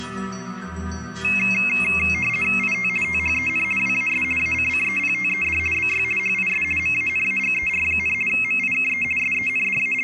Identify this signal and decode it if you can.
RTTY (50 baud, 450 Hz shift), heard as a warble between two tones, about 2350 Hz centre. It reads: IT THEN WAS ACCEPTED BY HIS MANAGER, MIKE …